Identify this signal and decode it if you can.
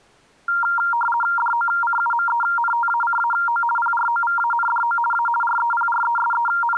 RTTY (50 baud, 450 Hz shift), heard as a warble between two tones, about 1170 Hz centre. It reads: DOCUMENTACAO PROVANDO A …